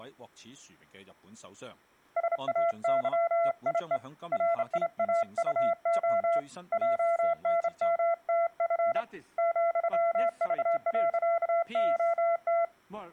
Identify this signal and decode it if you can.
Morse code, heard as a keyed tone, hand-sent with a straight key, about 28 wpm, 680 Hz. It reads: SAYIE RIAUO JNMTF ,V.OT